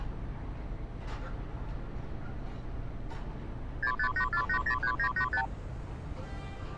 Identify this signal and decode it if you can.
Multi-frequency trunk signalling (R2, with the far end's replies), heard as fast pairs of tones, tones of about 80 ms, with street noise. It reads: 6584803985